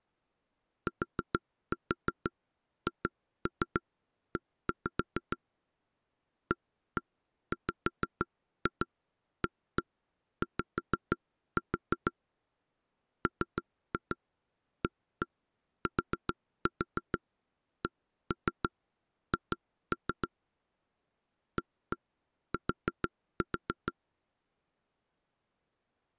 Tap code, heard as knocks on wood, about 6 knocks a second. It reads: THE AWAY MATCH AT